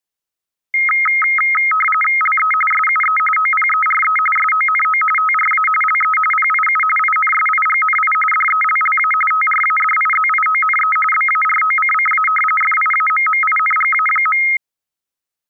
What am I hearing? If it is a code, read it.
RTTY (45.45 baud, 850 Hz shift), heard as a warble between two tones, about 1700 Hz centre. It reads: LE SUE OPERE SONO TRA LE PIU INSIGNI DELLA TRADIZIONE BAROCCA FIAMMINGA.